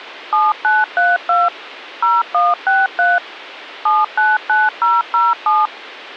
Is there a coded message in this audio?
Yes: DTMF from 0.3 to 5.7 s, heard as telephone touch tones, dialled by machine, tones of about 190 ms. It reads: 7932 0163 799007